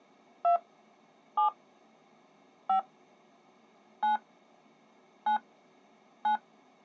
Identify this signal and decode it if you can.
DTMF, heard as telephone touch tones, dialled by hand, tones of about 110 ms. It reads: 2 7 5 9 9 9